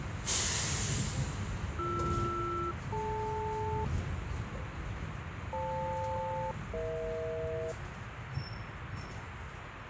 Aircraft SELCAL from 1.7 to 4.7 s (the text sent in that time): BR-DL